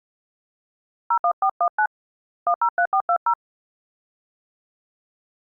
DTMF, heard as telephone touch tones, dialled by hand, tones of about 80 ms. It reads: 01419 103420